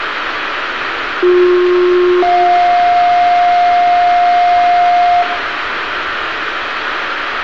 Two-tone page, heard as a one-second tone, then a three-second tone, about 360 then 710 Hz, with radio hiss, room echo and street noise.